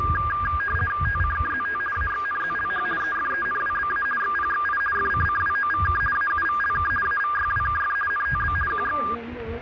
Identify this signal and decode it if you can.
RTTY (50 baud, 450 Hz shift), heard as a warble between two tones, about 1410 Hz centre, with radio static and the noise of a residential street. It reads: TCKZT AXNZLH EFENWBA XPXI FCCWOVK AUVLK AVYWKF NTB QX